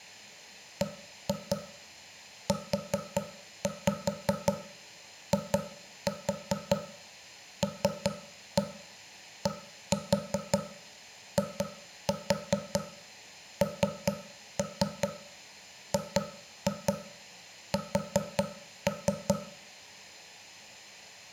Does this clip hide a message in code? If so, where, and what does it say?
Yes: tap code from 0.8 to 19.4 s, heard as knocks on wood, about 5 knocks a second, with room echo. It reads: BUILDINGS